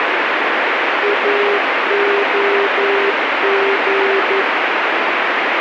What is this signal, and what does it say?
Morse code, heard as a keyed tone, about 11 wpm, 400 Hz, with heavy radio static. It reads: AOG